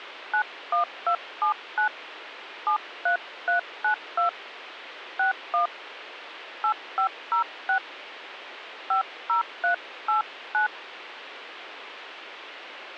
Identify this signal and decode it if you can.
DTMF, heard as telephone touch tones, dialled by hand, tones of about 110 ms, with radio hiss. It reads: 91279 73392 61 8506 50389